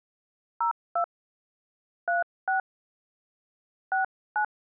DTMF, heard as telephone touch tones, dialled by hand, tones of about 130 ms. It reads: 02 36 69